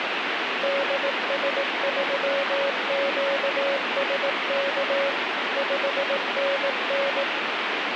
Morse code, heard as a keyed tone, machine-sent, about 18 wpm, 560 Hz, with heavy radio static. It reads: DS3QSK 5NN